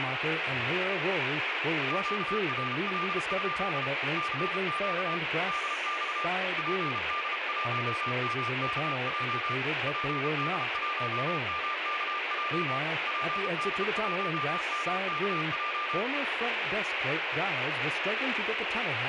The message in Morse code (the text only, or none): QRL? CQ DX PD1MKJ PD1MKJ PD1MKJ